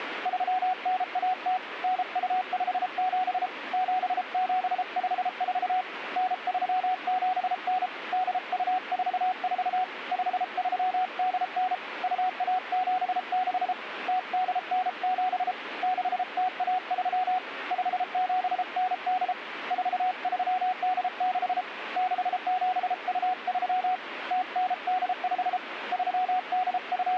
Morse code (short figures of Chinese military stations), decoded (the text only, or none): 3910 9257 7754 9379 8244 5389 2176 0897 6013 5798 4386 6723 0985 …